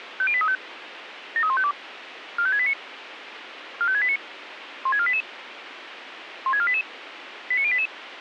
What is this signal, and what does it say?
Five-tone selective call (ZVEI), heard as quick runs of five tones, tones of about 70 ms, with radio hiss. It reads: 50835 73152 45689 45689 16488 16488 89088